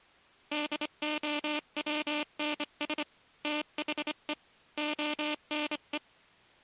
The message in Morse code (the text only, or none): DOWNS THE ONE